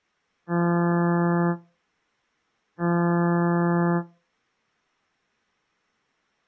Ship horn signal, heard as a ship's horn, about 170 Hz. 2 short. At sea: I am altering course to port.